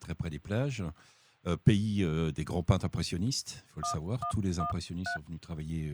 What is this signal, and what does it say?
DTMF, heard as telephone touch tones, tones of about 100 ms. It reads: 1113